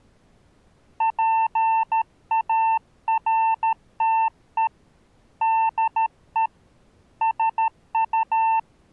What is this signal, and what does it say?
Morse code, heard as a keyed tone, hand-sent with a paddle, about 13 wpm, 900 Hz. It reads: PARTE DE SU